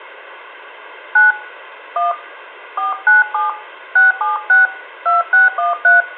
DTMF, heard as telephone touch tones, dialled by hand, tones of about 160 ms, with hum and room echo. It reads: 9 1 497 676 2613